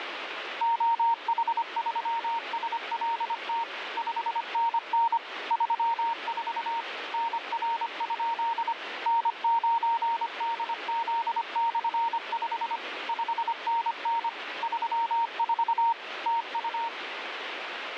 Morse code, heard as a keyed tone, machine-sent, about 25 wpm, 920 Hz, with radio static. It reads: OH3SLT 5NN 34 NR? N9DZ/5 5NN 34 TU